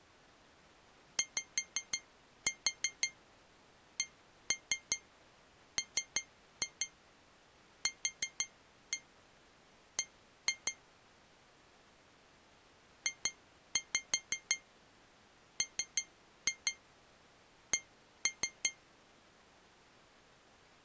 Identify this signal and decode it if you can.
Tap code, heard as taps on glass, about 5 knocks a second. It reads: YCMQB JMC